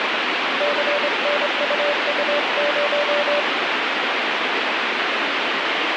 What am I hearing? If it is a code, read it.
Morse code, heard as a keyed tone, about 24 wpm, 580 Hz, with heavy radio static. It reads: CNUU0